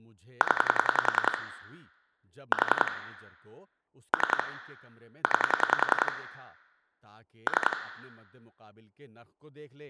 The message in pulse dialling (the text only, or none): 0 4 3 9 3